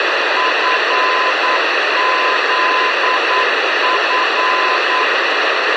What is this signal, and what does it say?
Morse code, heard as a keyed tone, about 9 wpm, 1020 Hz, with radio hiss and a squelch burst at the end. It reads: FZF